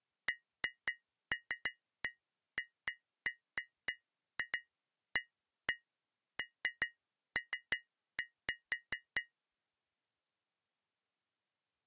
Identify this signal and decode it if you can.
Irregular taps on glass. There is no code.